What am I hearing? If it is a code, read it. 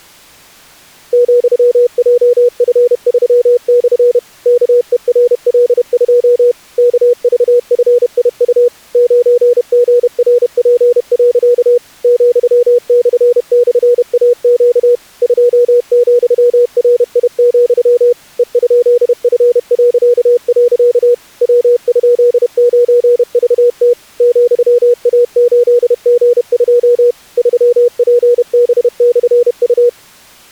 Morse code, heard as a keyed tone, machine-sent, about 31 wpm, 480 Hz. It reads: ,JF3/ KERL2 KVFIU 9GRP. ,//AQ 2,RI, E?F.. W?9VT ,A8G2 3PB/U